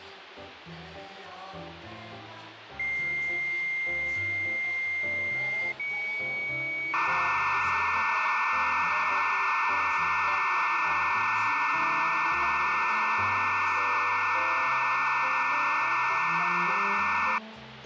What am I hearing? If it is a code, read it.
Dial-up modem handshake (low-speed, two carriers), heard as two whistles, then hiss, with phone line noise.